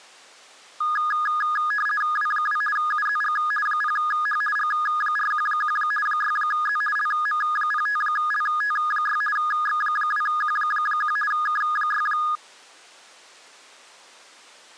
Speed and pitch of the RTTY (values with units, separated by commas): 50 baud, 450 Hz shift, 1450 Hz centre